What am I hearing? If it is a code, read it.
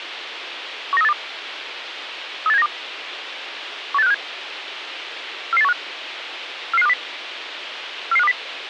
Five-tone selective call (EEA), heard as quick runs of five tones, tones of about 40 ms, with radio hiss. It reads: 19382 38792 18657 44815 44520 44520